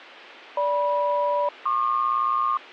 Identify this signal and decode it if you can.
Aircraft SELCAL, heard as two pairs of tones. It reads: GM-PQ